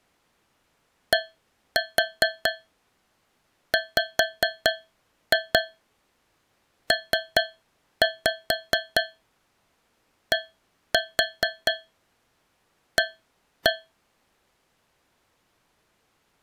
Tap code, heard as taps on a metal pipe, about 4 knocks a second. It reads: DWPDA